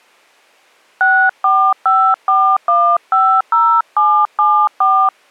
DTMF, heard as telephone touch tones, dialled by hand, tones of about 290 ms. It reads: 6454150774